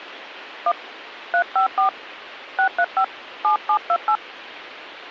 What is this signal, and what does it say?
DTMF, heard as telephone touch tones, dialled by hand, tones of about 80 ms, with radio hiss. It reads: 1 354 635 7728